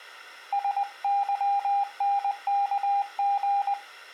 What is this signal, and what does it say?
Morse code, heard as a keyed tone, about 20 wpm, 800 Hz. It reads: SYNKG